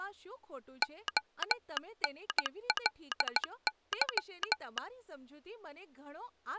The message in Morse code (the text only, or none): ONLY